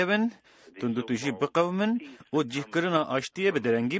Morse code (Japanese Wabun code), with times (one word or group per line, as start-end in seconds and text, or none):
none